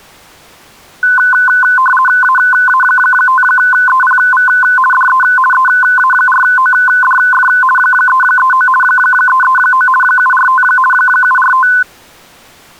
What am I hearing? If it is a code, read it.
RTTY (50 baud, 450 Hz shift), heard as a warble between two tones, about 1260 Hz centre. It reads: AA5EPV DE EA4ODF 339 339 745 745